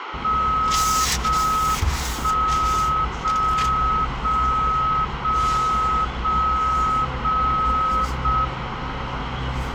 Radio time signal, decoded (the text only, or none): 0 1 0 0 0 0 0 0 M